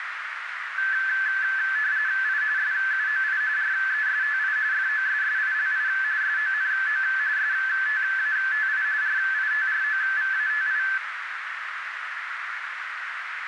RTTY (45.45 baud, 170 Hz shift), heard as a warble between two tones, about 1650 Hz centre, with radio static and a narrow filter. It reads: I SUOI RESTI FOSSILI SONO STATI RITROVATI